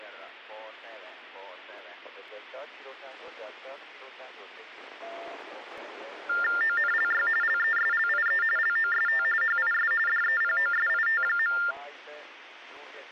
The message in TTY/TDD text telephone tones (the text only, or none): ONLY LESLIE LOST HIS DEPOSIT.